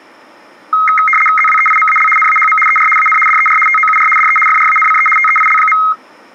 RTTY (75 baud, 850 Hz shift), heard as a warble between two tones, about 1700 Hz centre. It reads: ZWEIMAL NAHM ER AN DER TOUR DE FRANCE TEIL.